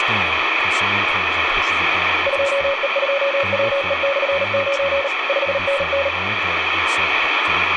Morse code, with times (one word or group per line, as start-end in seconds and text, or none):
2.3-5.1 2E2WE/9
5.3-6.1 5NN